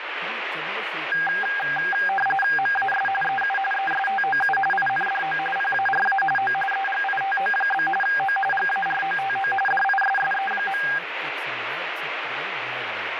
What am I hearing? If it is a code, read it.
RTTY (45.45 baud, 850 Hz shift), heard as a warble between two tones, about 1200 Hz centre, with radio static and speech in Hindi. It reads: MAS EU ESTOU INDO PARA O EGITO? O GAROTO DISSE.